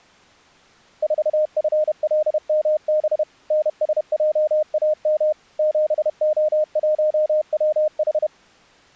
Morse code, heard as a keyed tone, machine-sent, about 31 wpm, 610 Hz. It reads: 4FLMB NSJAM 7O1WH